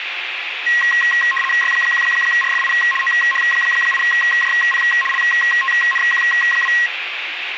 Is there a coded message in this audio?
Yes: RTTY (75 baud, 850 Hz shift) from 0.7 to 6.9 s, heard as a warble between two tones, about 1490 Hz centre, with radio static and room echo. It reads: Y1RFI OH8JP LTNQ2